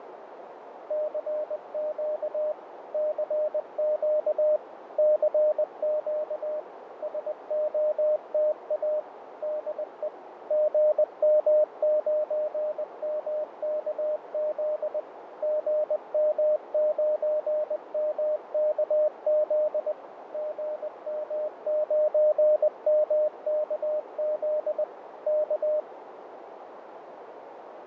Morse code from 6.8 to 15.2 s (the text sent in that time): SOTA DE GM9MKZ